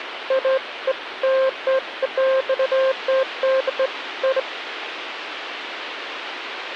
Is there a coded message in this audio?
No, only beeps of irregular length, with phone line noise.